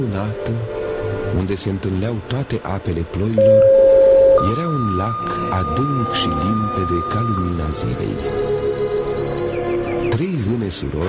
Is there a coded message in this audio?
Yes: two-tone page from 3.4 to 7.4 s, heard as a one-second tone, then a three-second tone, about 540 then 1220 Hz, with a squelch burst at the end and room echo.